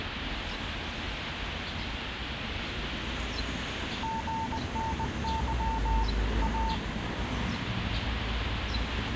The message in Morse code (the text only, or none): GNY A